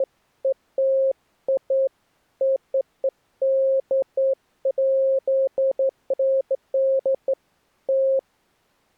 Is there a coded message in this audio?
No, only beeps of irregular length.